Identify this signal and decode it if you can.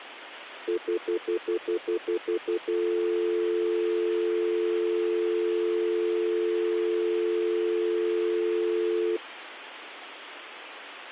Telephone call progress tone (North American plan), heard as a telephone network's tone, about 350, 440 Hz, 0.1 s on and 0.1 s off. Stutter dial tone.